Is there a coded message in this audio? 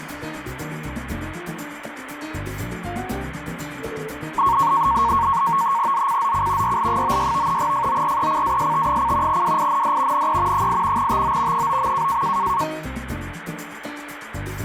Yes: NAVTEX (SITOR-B), 100 baud, 170 Hz shift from 4.4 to 12.6 s, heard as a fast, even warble, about 1010 Hz centre, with radio static. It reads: ZCZC YL96 FORECAST: WIND NE 8 TO 9.